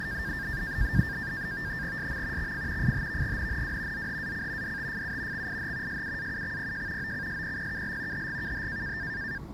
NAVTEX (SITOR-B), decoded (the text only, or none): SM XF FHVGNNW ZHAC DTFU XIH SUAUXPJ OCSPPKL HGKH